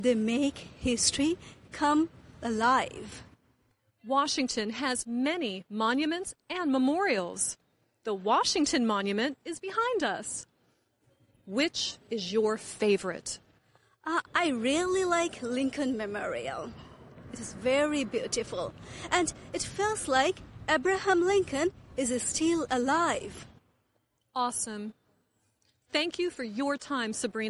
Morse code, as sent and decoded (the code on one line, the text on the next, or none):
none